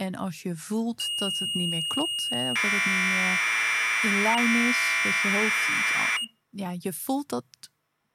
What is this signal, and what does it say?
Commodore tape loading (standard loader), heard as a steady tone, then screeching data, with speech in Dutch.